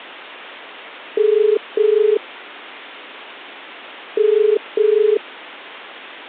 Telephone call progress tone (as in the UK, Ireland, Australia and similar networks), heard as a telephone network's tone, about 430 Hz. Ringback tone.